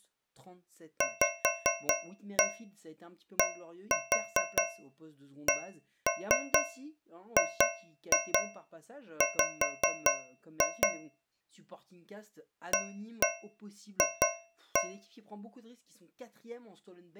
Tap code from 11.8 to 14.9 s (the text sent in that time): AF